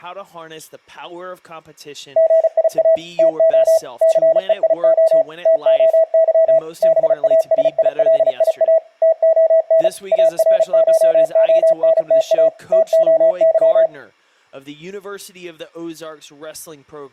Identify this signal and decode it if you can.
Morse code (Greek alphabet), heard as a keyed tone, machine-sent, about 35 wpm, 650 Hz, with speech in English. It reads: ΓΙΑ ΤΟ ΘΕΙΟ ΤΟΥ ΒΑΣΙΛΙΑ ΤΟΝ ΑΡΧΟΝΤΑ ΤΟΥ